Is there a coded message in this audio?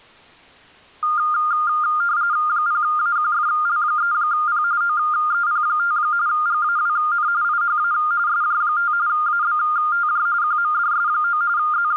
Yes: RTTY (45.45 baud, 170 Hz shift) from 1.0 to 12.0 s, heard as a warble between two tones, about 1310 Hz centre. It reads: 0AQFL3P OEP5 GAWN IHA SJ5 ABTJ QMDS9 …